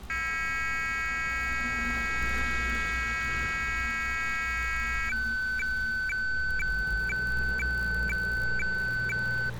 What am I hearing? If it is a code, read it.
Weather fax (radiofax), 120 lines a minute, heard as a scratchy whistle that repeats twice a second, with street noise.